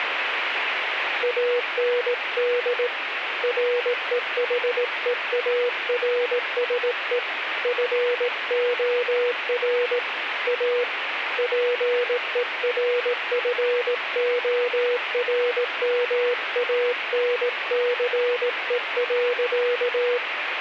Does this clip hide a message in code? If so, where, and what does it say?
Yes: Morse code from 1.2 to 20.2 s, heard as a keyed tone, hand-sent with a paddle, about 18 wpm, 490 Hz, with radio static. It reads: AND REHEARSE FOR A PERFORMANCE.